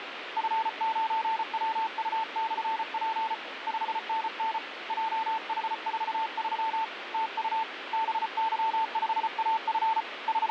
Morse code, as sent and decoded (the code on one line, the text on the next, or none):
..-. ----. .-- ..- -..-. .--. / ..... -. -. / .--- .... ....- ...-- / - ..- / -... -.-- ..... .- ..-. / …
F9WU/P 5NN JH43 TU BY5AF …